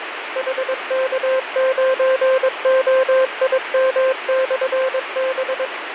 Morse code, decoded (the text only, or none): HK9OIM/B